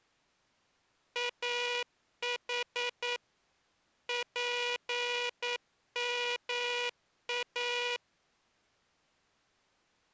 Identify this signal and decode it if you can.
Morse code (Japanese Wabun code), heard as a buzzer, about 9 wpm. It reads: イヌ ツヨイ